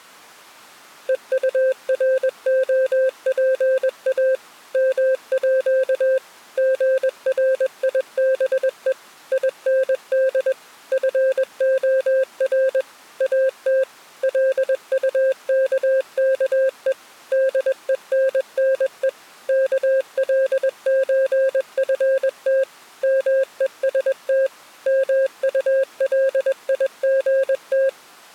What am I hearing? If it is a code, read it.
Morse code (with Danish letters), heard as a keyed tone, machine-sent, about 21 wpm, 530 Hz. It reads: EUROPA MÅ GRIBE IND FOR AT LUKKE DENNE KLØFT MEST MULIGT